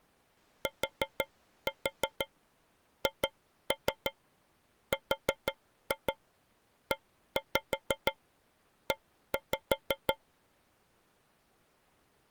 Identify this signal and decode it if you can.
Tap code, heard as taps on a metal pipe, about 6 knocks a second. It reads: THREE